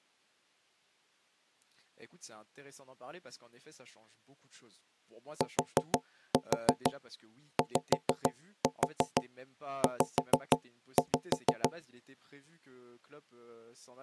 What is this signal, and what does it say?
Tap code, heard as knocks on wood, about 6 knocks a second, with speech in French. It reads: TYZ